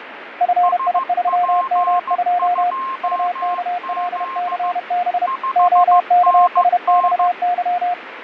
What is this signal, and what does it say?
Morse code, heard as two keyed tones, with radio static and fading. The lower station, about 31 wpm, 710 Hz: FI3M2 UKLCB OKSXY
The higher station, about 15 wpm, 1060 Hz: SP2Z 5NN